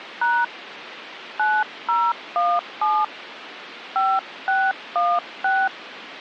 DTMF, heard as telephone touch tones, dialled by hand, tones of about 230 ms, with phone line noise. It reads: # 9017 5616